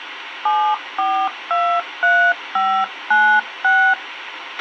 DTMF, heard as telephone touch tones, dialled by hand, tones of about 290 ms, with radio hiss and a squelch burst at the end. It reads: 7423596